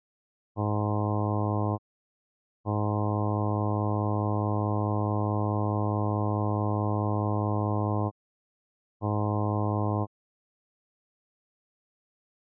Ship horn signal, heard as a ship's horn, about 100 Hz. 1 short, 1 long, 1 short. At sea: a vessel at anchor warns of its position.